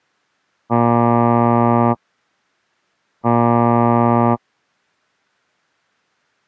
Ship horn signal, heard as a ship's horn, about 120 Hz. 2 short. At sea: I am altering course to port.